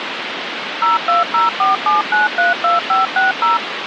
DTMF, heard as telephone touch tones, dialled by machine, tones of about 150 ms, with phone line noise. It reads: 02047932560